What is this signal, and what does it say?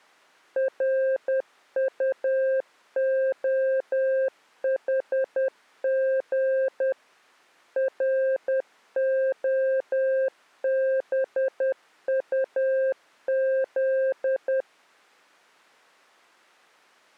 Morse code, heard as a keyed tone, machine-sent, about 10 wpm, 530 Hz. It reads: RUOHG ROBUZ